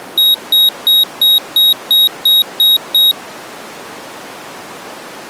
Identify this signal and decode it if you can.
Beep code, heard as a piezo beeper, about 3800 Hz. 9 short. In AMI BIOS tables: ROM checksum failure.